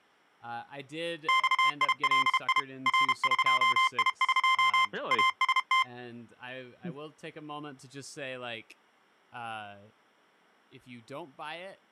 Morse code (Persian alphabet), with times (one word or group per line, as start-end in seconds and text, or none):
1.3-2.6 خیلی
2.9-4.8 رقیق
5.1-5.8 است